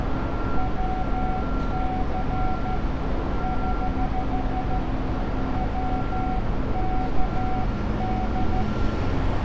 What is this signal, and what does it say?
Morse code, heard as a keyed tone, hand-sent with a straight key, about 13 wpm, 750 Hz, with radio static, a narrow filter and street noise. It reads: WC <HH> WKD